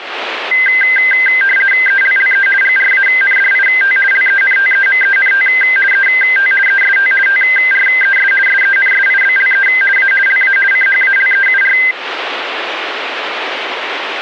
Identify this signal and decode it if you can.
RTTY (50 baud, 450 Hz shift), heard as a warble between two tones, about 1800 Hz centre. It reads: ELLE GRANDIT LENTEMENT ET EST TRES SENSIBLE A LA CHALEUR